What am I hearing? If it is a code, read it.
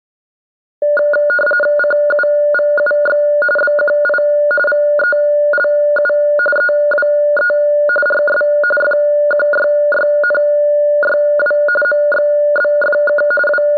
RTTY (45.45 baud, 850 Hz shift), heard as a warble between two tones, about 1010 Hz centre. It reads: CUVUX BQI VELU EWE RS FQYYNYW MXBFK …